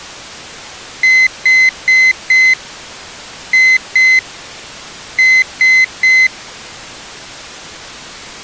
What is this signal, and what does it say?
Beep code, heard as a piezo beeper, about 2050 Hz. 4-2-3. In Phoenix BIOS tables: gate A20 failure.